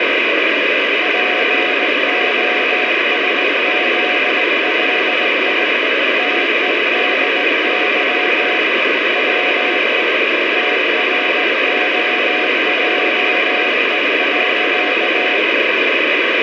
Morse code, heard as a keyed tone, hand-sent with a straight key, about 18 wpm, 720 Hz, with heavy radio static. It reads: POSZLI TEDY WE TROJE.